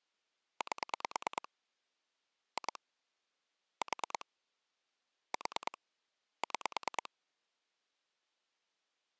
Pulse dialling, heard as clicks on a phone line, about 9 pulses a second. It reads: 8 2 4 4 6